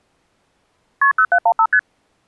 Multi-frequency trunk signalling (R1, as on North American trunks), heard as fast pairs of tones, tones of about 70 ms. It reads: KP 0715 ST